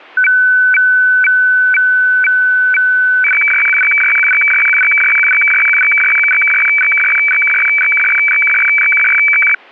Weather fax (radiofax), 120 lines a minute, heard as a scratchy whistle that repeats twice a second.